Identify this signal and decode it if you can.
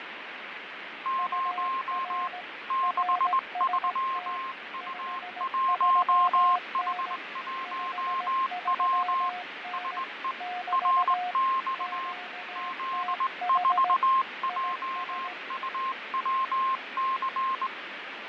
Morse code, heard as two keyed tones, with radio static and fading. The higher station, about 19 wpm, 1060 Hz: 0 63U1H1W SE RX Z4JUWC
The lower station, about 17 wpm, 720 Hz: UR RST 53N 53N <BT> QTH IS